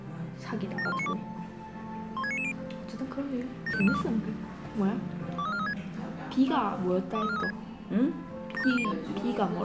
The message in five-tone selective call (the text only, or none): 74192 16990 75542 23436 23436 75401